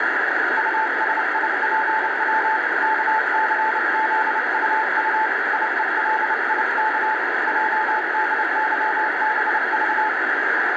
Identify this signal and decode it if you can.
Morse code, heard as a keyed tone, hand-sent with a paddle, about 29 wpm, 870 Hz, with heavy radio static. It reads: USIPW KCZUU IELIK JDYBV